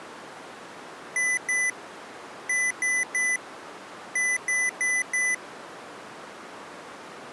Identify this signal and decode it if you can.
Beep code, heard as beeps from a small speaker, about 2000 Hz. 2-3-4.